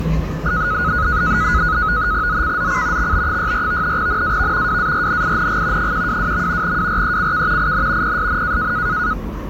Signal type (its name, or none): NAVTEX (SITOR-B)